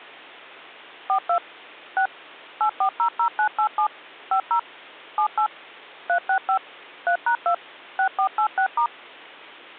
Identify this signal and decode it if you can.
DTMF, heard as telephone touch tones, dialled by machine, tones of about 90 ms, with hum. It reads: 42 6 8400987 50 78 365 3#2 6486*